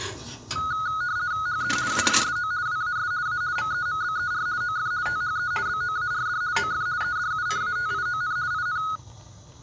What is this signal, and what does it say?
RTTY (50 baud, 170 Hz shift), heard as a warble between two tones, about 1360 Hz centre, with kitchen noise. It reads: HE ALSO WAS A MEMBER OF THE BOARD OF EDUCATION IN